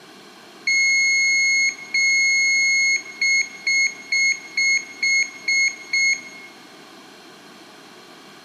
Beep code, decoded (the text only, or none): 2 long, 7 short